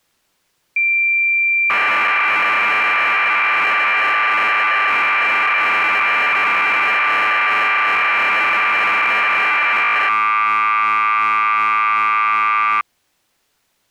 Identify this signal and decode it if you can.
Cassette data (Kansas City type), 1200 baud, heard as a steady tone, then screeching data.